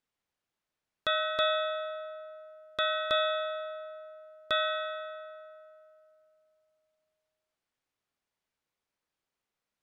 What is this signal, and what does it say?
Ship's bell, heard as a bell. 5. Five half-hours of the watch have passed.